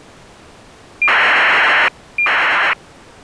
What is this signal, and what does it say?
ACARS aircraft data, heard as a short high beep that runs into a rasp, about 2400 baud.